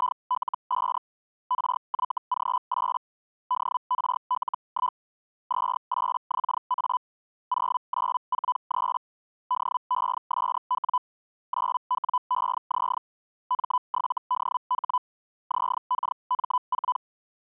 Hellschreiber (Feld-Hell, 122.5 baud), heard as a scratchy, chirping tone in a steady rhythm, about 1000 Hz. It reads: … RYG8 DRL1 28XA 0943 DESW 9WEZ M7DH ZKM4